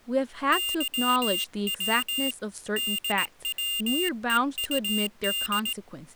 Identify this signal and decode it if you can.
Morse code, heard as a high beeper, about 18 wpm, 2800 Hz, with speech in English. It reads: YW DWEUD